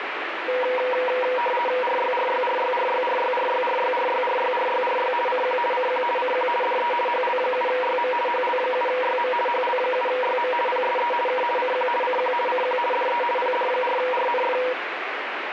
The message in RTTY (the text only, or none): RYRYRYRYRYRYRYRYRYRYRY CQ CQ CQ DE HL7YM HL7YM HL7YM PSE K CQ CQ CQ DE PD4RNF